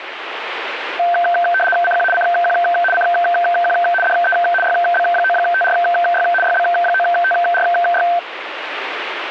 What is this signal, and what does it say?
RTTY (75 baud, 850 Hz shift), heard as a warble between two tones, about 1120 Hz centre, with radio static. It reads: CQ CQ CQ DE YB9TRY YB9TRY